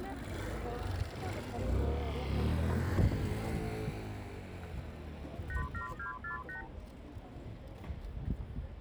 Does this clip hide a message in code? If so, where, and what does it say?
Yes: multi-frequency trunk signalling (R2, with the far end's replies) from 5.5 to 6.7 s, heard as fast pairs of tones, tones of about 120 ms, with the noise of a residential street. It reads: 87248